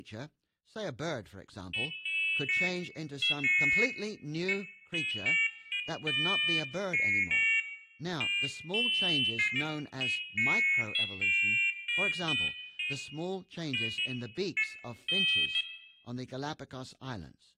Pairs of high tones at irregular times, with room echo and speech in English. There is no code.